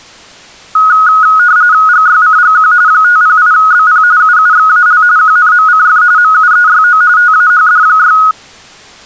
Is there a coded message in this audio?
Yes: RTTY (45.45 baud, 170 Hz shift) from 0.8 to 8.3 s, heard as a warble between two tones, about 1360 Hz centre. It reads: GYCGQ 508BP UUXAL QNMCF MUEYO TAHD6